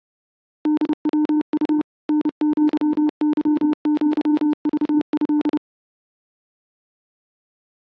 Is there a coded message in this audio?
Yes: Morse code (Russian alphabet) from 0.6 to 5.6 s, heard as a keyed tone, machine-sent, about 30 wpm, 300 Hz. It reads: ДВУ НЪЫЪЖЭ